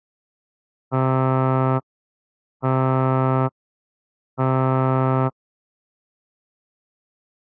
Ship horn signal, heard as a ship's horn, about 130 Hz. 3 short. At sea: I am operating astern propulsion.